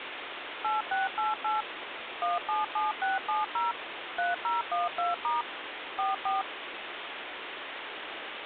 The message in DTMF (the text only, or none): 8688 177670 3012* 44